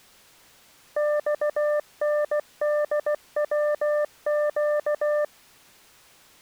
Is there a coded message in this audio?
Yes: Morse code (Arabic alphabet) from 0.9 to 5.3 s, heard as a keyed tone, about 16 wpm, 600 Hz. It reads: صندوق